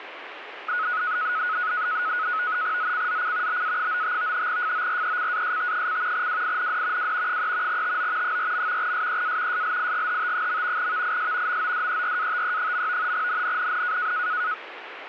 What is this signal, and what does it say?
NAVTEX (SITOR-B), 100 baud, 170 Hz shift, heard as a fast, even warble, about 1370 Hz centre, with radio static. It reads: ZCZC BA95 FORECAST: WIND W 3 TO 4. SEA SLIGHT. VIS MODERATE. NNNN